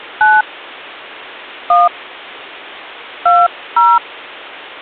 DTMF, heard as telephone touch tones, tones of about 210 ms. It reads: 9 1 20